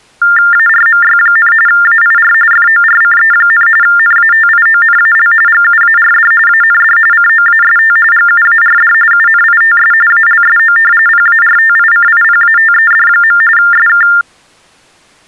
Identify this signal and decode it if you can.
TTY/TDD text telephone tones (45.45 baud Baudot), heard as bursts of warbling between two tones, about 400 Hz shift, 1600 Hz centre. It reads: ARMY, AIR FORCE, NATIONAL GUARD AND COAST GUARD UNITS ALSO PARTICIPATED. SK